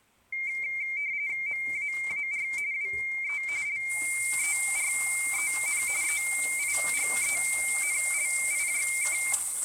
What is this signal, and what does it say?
RTTY (45.45 baud, 170 Hz shift), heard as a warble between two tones, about 2200 Hz centre, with room echo and kitchen noise. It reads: MAAR WE LEREN EIGENLIJK